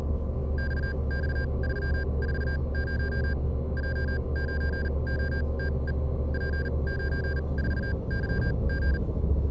Morse code, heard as electronic beeps, machine-sent, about 39 wpm, spaced as for 28 wpm, 1600 Hz, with the noise inside a bus. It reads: XX340 J9OTE P94YG